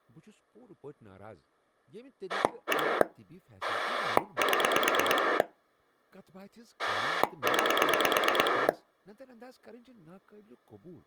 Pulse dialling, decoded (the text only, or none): 1 7 9